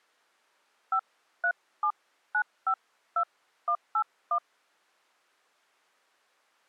DTMF, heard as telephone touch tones, dialled by hand, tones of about 80 ms. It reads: 537952181